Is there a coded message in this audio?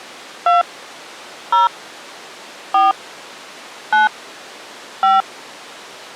Yes: DTMF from 0.5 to 5.2 s, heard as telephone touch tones, dialled by hand, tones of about 160 ms. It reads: 2 0 4 9 5